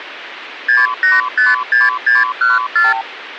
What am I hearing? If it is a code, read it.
Multi-frequency trunk signalling (R2, with the far end's replies), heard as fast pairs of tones, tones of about 170 ms, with phone line noise. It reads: 6856614